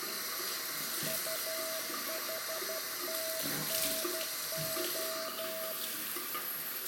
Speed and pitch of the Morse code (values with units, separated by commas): 12 wpm, 650 Hz